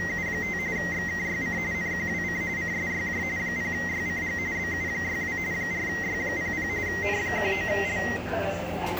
RTTY (45.45 baud, 170 Hz shift), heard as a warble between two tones, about 2000 Hz centre, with radio static and the noise of a subway station. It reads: … XKYC NQWC CSYJ 0YCG BU62 4Y00 N19L